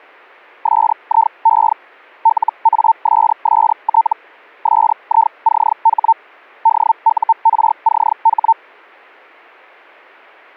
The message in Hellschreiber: SIE LASST SICH DURCH

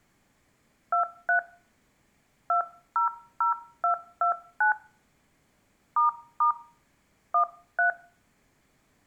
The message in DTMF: 23 200229 ** 13

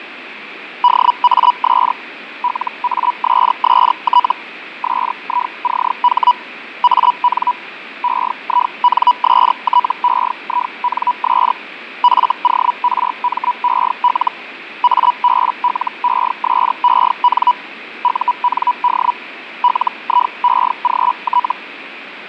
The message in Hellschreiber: DAS LASST SICH AN EINSTEINS FORMEL ABLESEN UND LIEGT

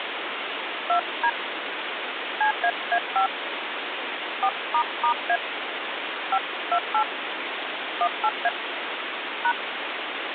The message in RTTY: none

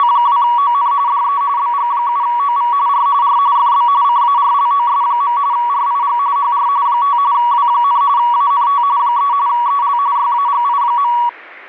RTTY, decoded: … DE BG7OV R R FB CARLOS. RIG HR 5 W, ANT 3 EL YAGI.

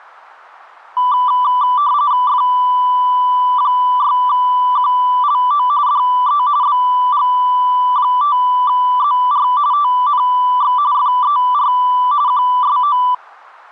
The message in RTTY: F6QLO DE BG5ZR TNX FER QSO

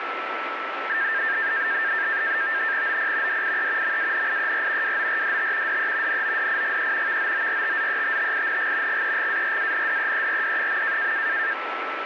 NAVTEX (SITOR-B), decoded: OP DIE MANIER WORDT DE NODIGE VOORTZETTING GEGARANDEERD.

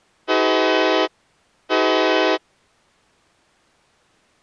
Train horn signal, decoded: 2 short

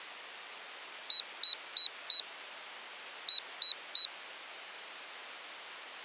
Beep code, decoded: 4-3

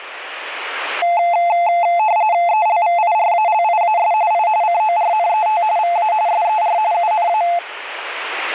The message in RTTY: ELVIRALIAS I CORNET VA SER UNA

